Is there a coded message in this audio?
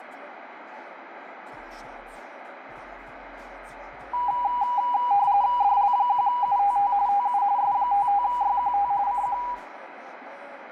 Yes: RTTY (45.45 baud, 170 Hz shift) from 4.1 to 9.5 s, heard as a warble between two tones, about 890 Hz centre, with radio static. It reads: DL1UTT TU S55YQT CQ